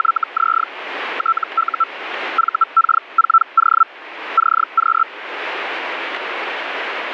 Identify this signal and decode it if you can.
Hellschreiber (Feld-Hell, 122.5 baud), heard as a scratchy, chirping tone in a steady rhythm, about 1330 Hz, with radio static. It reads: … TU VK4O CQ